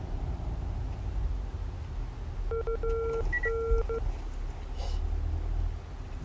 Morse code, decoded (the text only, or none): UN